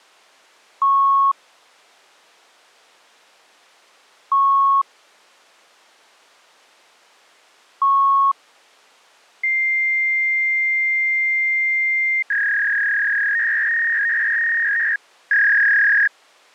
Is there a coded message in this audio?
Yes: fax machine handshake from 0.8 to 16.1 s, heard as beeps, a long tone and a warble.